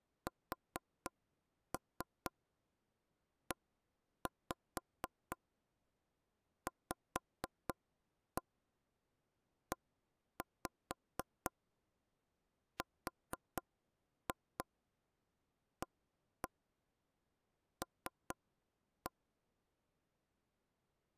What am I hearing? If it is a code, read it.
Tap code, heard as knocks on wood, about 4 knocks a second. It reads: SEVERAL